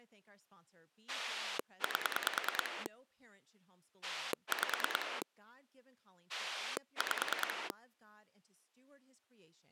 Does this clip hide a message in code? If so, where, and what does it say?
Yes: pulse dialling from 1.1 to 7.7 s, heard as a rotary dial, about 9 pulses a second, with speech in English. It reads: 8 5 5